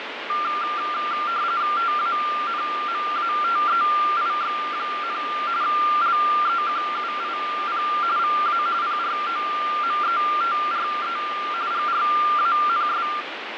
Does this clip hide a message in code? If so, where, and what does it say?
Yes: RTTY (45.45 baud, 170 Hz shift) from 0.3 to 13.2 s, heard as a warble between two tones, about 1280 Hz centre, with radio static and fading. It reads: TANMATEIX, LEQUIP VA PROMETRE GRANS